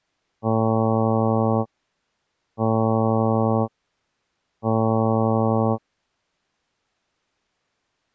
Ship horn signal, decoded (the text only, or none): 3 short